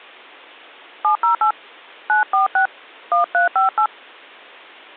DTMF, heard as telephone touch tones, dialled by hand, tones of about 110 ms. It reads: 708 946 1358